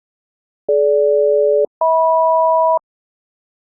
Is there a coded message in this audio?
Yes: aircraft SELCAL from 0.7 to 2.8 s, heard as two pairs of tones. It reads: DG-HM